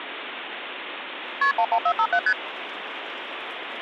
Multi-frequency trunk signalling (R1, as on North American trunks), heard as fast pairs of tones, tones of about 70 ms, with phone line noise. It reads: KP 11457 ST